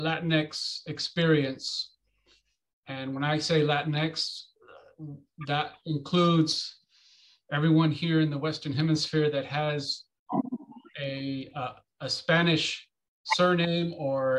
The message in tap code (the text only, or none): none